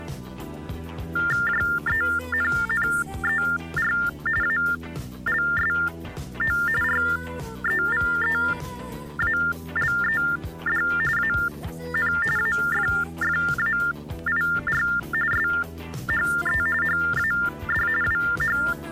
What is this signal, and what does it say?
TTY/TDD text telephone tones (45.45 baud Baudot), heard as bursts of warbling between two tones, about 400 Hz shift, 1600 Hz centre. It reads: JENNER ALSO REVEALED AN AFFAIR SHE HAD …